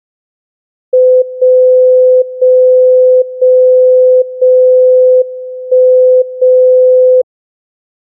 Radio time signal (WWVB), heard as a tone whose level steps once a second, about 510 Hz. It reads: 0 0 0 0 1 0